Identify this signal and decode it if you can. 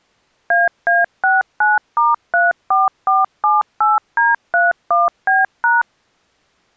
DTMF, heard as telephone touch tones, dialled by machine, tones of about 180 ms. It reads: AA69*34478D31B#